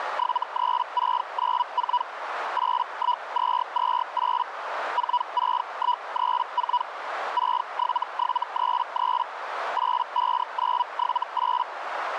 Hellschreiber (Feld-Hell, 122.5 baud), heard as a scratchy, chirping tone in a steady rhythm, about 980 Hz, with radio static and a narrow filter. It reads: 73694 81228 46134 67733 85978